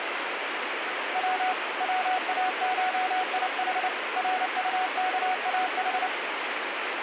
Morse code (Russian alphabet), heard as a keyed tone, hand-sent with a paddle, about 29 wpm, 740 Hz, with radio static. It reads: В ВАШИХ РУКАХ